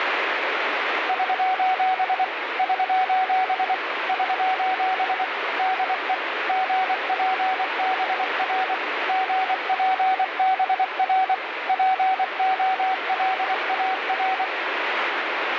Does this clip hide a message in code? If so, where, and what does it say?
Yes: Morse code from 1.0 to 14.5 s, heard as a keyed tone, machine-sent, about 24 wpm, 750 Hz, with radio static. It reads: <SOS> <SOS> <SOS> DE GPBR GPBR POLAR